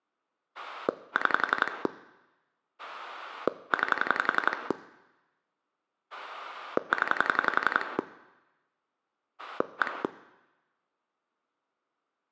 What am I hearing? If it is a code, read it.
Pulse dialling, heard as a rotary dial, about 11 pulses a second, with room echo. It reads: 6 9 0 1